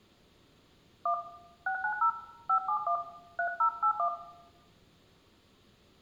DTMF, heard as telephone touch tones, dialled by hand, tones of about 90 ms, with room echo. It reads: 1 690 571 3081